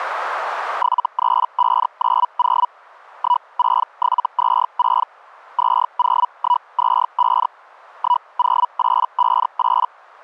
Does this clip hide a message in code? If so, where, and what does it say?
Yes: Hellschreiber (Feld-Hell, 122.5 baud) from 0.8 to 9.9 s, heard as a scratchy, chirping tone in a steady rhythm, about 980 Hz. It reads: 73590 16726 20125 10858